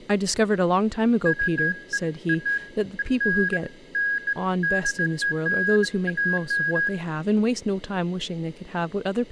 Beeps of irregular length, with speech in English. There is no code.